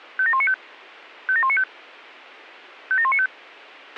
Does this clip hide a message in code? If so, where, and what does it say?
Yes: five-tone selective call (ZVEI) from 0.2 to 3.3 s, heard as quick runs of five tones, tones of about 70 ms, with a squelch burst at the end. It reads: 57195 57195 57195